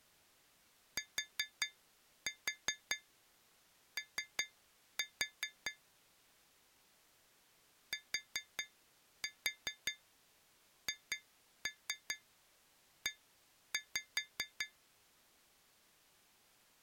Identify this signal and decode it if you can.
Tap code, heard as taps on glass, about 5 knocks a second. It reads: TO THE